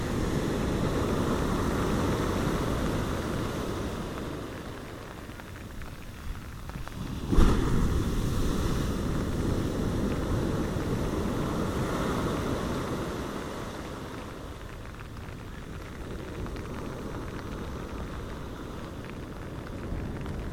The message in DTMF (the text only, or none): none